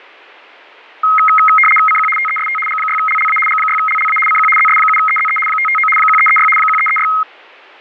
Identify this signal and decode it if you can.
RTTY (75 baud, 850 Hz shift), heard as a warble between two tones, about 1700 Hz centre, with fading. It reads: CQ TEST G6LLA G6LLA CQ ZS7EZE 559 1336 1336